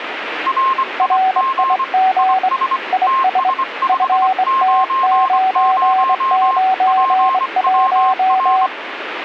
Morse code, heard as two keyed tones, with radio static. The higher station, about 24 wpm, 1060 Hz: RIG IS TS590 PWR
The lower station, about 24 wpm, 760 Hz: RIG IS FT991